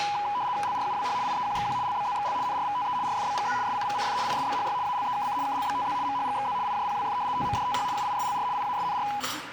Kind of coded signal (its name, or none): RTTY